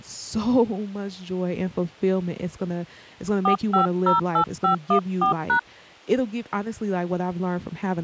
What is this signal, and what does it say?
DTMF, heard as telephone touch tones, dialled by hand, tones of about 110 ms, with speech in English. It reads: 4508514#